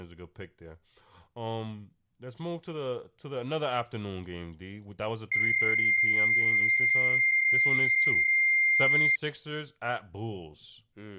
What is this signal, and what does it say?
PSK31 (31.25 baud), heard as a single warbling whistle, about 2100 Hz, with speech in English.